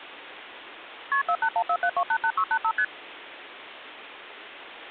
Multi-frequency trunk signalling (R1, as on North American trunks), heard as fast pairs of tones, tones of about 70 ms, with phone line noise. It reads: KP 48147288685 ST